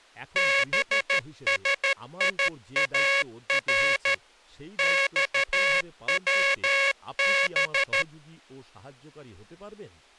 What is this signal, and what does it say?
Morse code (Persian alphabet), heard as a buzzer, machine-sent, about 13 wpm, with speech in Bangla. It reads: بسیار خوب